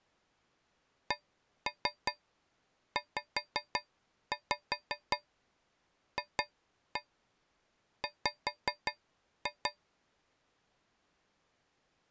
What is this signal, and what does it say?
Tap code, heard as taps on a metal pipe, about 5 knocks a second. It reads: CZFW